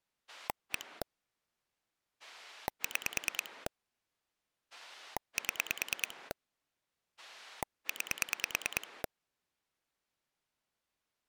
Pulse dialling, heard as a rotary dial, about 9 pulses a second. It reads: 1 6 7 9